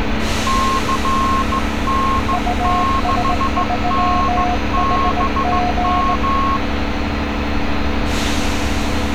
Morse code, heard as two keyed tones, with street noise. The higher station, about 15 wpm, 1080 Hz: CN6NBM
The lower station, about 18 wpm, 720 Hz: US3HG